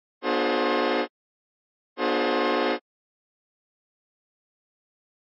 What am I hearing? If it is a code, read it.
Train horn signal, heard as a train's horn. 2 short. On North American railways: a signal is acknowledged.